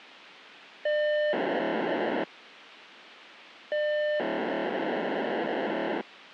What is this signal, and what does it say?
POCSAG pager data (1200 baud), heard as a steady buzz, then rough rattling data, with radio hiss.